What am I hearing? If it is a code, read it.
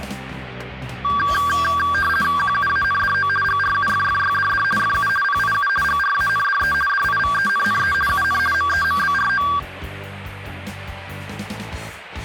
RTTY (50 baud, 450 Hz shift), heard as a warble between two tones, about 1370 Hz centre. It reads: QUANDO GRUFFYDD FU PIU GRANDE DIVENNE UN MEMBRO